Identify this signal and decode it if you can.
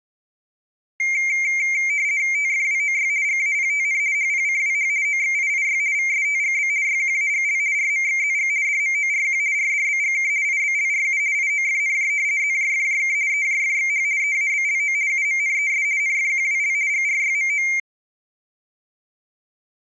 RTTY (50 baud, 170 Hz shift), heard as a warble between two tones, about 2200 Hz centre. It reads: TFWOY GAPTN HPCWH OXIIY VSTGB YQAGL RMXZG DMORQ RDBGK IBLRU IOFNJ ZJFJK EJFXH EABLO UMNES NFQWL GRYMO